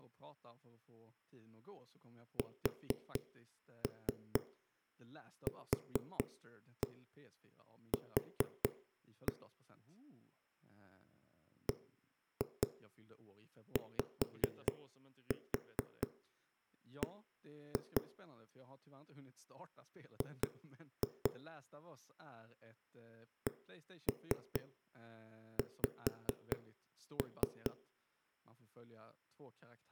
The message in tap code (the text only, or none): SQQ BYB G CX